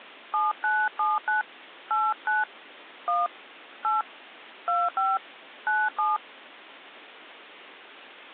DTMF, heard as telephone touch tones, dialled by hand, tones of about 200 ms. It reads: 7979 89 1 8 25 97